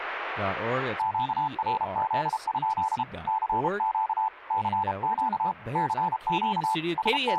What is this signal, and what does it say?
Morse code, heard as a keyed tone, hand-sent with a paddle, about 32 wpm, 880 Hz, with radio static and speech in English. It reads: QRZ? CQ CQ CQ …